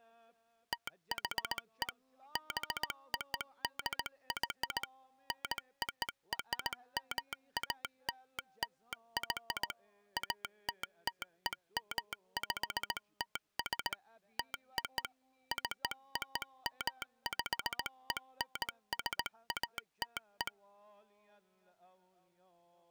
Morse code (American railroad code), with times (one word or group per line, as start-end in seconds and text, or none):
0.7-1.9 THE
2.4-4.8 BODY
5.3-9.7 NORMALLY
10.2-13.9 ATTEMPTS
14.4-15.0 TO
15.5-20.5 COMPENSATE